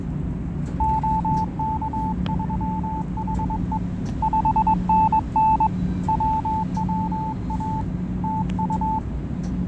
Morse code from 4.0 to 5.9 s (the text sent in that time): 5NN